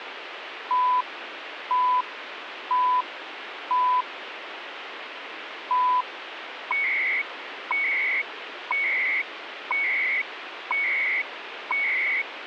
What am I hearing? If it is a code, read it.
Radio time signal (CHU, Canada), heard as beeps and data bursts, one a second, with radio static.